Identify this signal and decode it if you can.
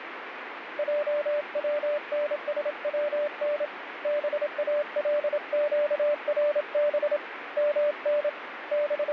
Morse code (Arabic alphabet), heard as a keyed tone, hand-sent with a paddle, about 27 wpm, 590 Hz, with radio static. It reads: جونسون بالقرب من …